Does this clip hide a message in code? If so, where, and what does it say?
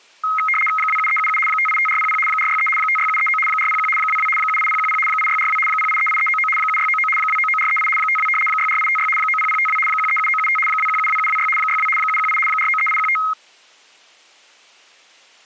Yes: RTTY (75 baud, 850 Hz shift) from 0.2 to 13.3 s, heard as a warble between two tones, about 1700 Hz centre. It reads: 27377 585400 463 56739 401 22 78010 8642 0838399 7699 299438 52 64856 90052 137975 2172726 62 718 493815